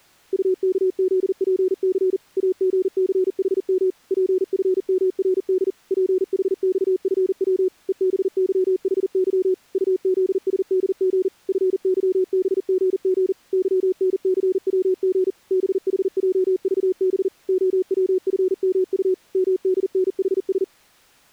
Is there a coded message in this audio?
Yes: Morse code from 0.3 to 20.7 s, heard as a keyed tone, machine-sent, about 40 wpm, 360 Hz. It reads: UKZPC AGCHM PFMRD PHXFW EBYHY UZSDG FYBGG YNCWG BHJVB OWFMU MDNHS